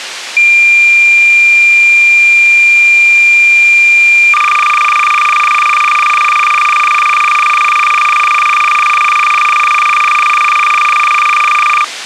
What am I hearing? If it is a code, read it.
Cassette data (Kansas City type), 300 baud, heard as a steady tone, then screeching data, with tape hiss.